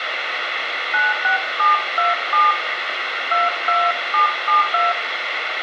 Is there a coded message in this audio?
Yes: DTMF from 0.9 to 4.9 s, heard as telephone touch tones, dialled by hand, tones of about 170 ms, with radio hiss and room echo. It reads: 96727 22772